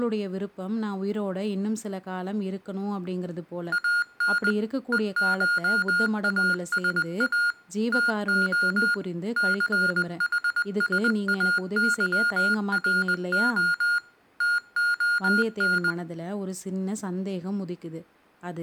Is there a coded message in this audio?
Yes: Morse code (Greek alphabet) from 3.7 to 16.0 s, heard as electronic beeps, machine-sent, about 20 wpm, 1420 Hz, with room echo and speech in Tamil. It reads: ΑΝ ΕΧΑΣΑ ΤΟ ΘΗΣΑΥΡΟ ΤΟΝ